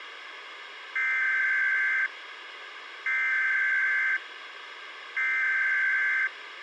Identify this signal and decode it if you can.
Emergency Alert System (SAME) tones (header bursts), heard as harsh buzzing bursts, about 520.83 baud, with radio hiss.